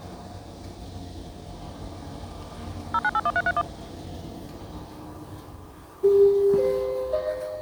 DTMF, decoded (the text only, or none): 0981331